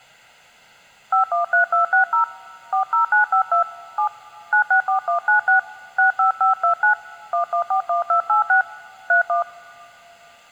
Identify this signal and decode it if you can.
DTMF, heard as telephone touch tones, dialled by hand, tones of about 110 ms. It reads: 513260 40952 7 964196 65529 1141286 31